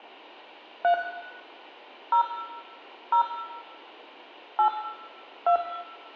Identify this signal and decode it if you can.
DTMF, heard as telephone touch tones, dialled by hand, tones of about 100 ms, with room echo. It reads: 3 0 0 8 2